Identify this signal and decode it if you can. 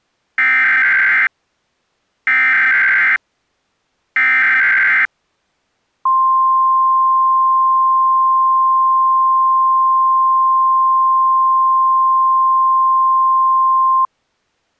Emergency Alert System (SAME) tones (header bursts, then the 1050 Hz attention tone), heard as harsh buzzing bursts, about 520.83 baud.